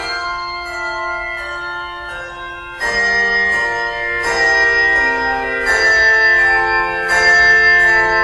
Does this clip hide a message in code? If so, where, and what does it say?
No.